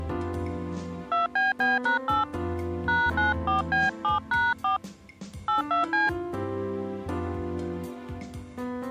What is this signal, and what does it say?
DTMF, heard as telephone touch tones, dialled by hand, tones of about 180 ms. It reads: 2BB#8 #94B7#4 82C